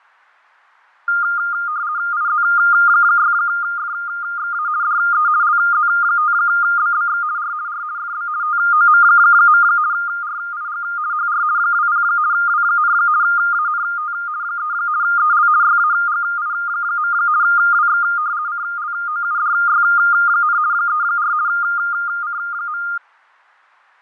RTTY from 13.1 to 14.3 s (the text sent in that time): ANT